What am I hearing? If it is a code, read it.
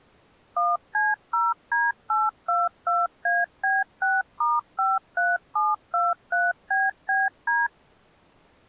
DTMF, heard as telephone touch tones, dialled by machine, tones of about 200 ms. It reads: 1C0D822AB6*53723BBD